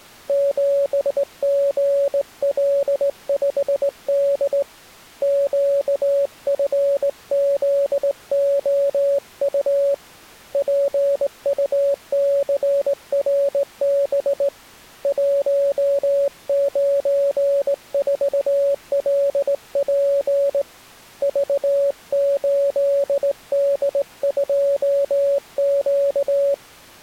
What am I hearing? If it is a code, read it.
Morse code, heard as a keyed tone, hand-sent with a straight key, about 18 wpm, 560 Hz. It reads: 7GL5D QFZOU PUCRB 194LP V8D2Q